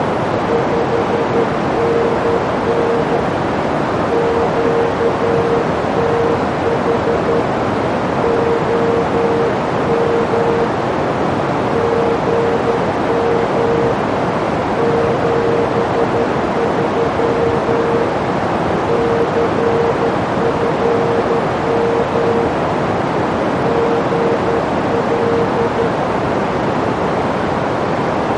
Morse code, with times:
0.5-3.2 5NN
4.1-7.4 QTH
8.2-10.6 OM
11.7-13.9 GM
14.8-18.0 73
18.9-22.5 CFM
23.6-25.9 GL

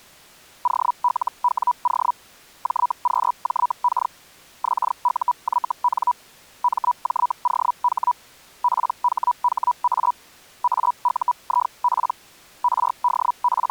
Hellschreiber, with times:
0.6-2.1 OLWO
2.6-4.1 JQJK
4.6-6.1 XUYN
6.6-8.1 MJOH
8.6-10.1 PHHA
10.6-12.1 AUIP
12.6-13.7 …

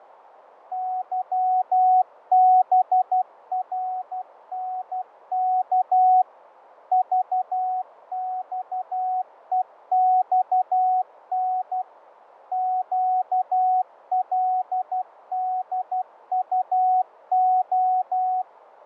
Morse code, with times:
0.7-6.2 YBRNK
6.9-11.8 VXEXN
12.5-18.4 QLDUO

